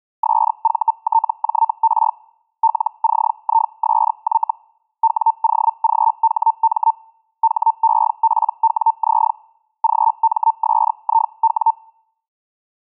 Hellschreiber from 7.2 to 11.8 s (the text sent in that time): HEPWZ GMSIW